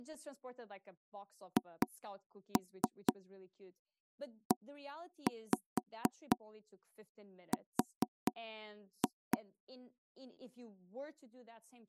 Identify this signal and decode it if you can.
Tap code, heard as knocks on wood, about 4 knocks a second, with speech in English. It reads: HER